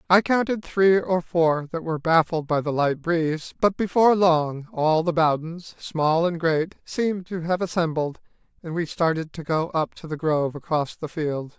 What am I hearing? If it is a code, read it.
Speech in English. There is no code.